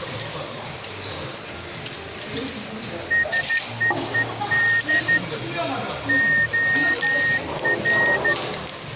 Morse code, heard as a whistle, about 13 wpm, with the noise of a restaurant. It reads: SEED OR